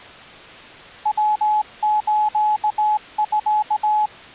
Morse code (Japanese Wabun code), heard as a keyed tone, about 19 wpm, 850 Hz. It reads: ヤスミ